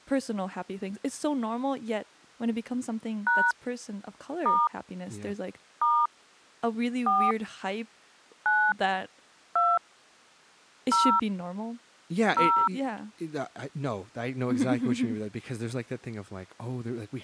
DTMF, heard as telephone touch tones, dialled by hand, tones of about 250 ms, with speech in English. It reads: # * * 4 9 2 0 0